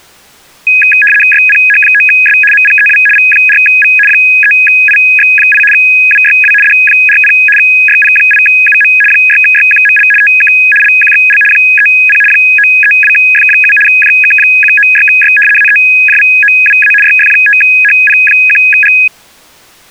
RTTY (75 baud, 850 Hz shift), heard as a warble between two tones, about 2100 Hz centre. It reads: YPH9S MPEW V4V 3IX8 WYW D40 YP8UM 6YQML TK LQXL 30 932F7 JK196Y AEJVOWA YF5HP1G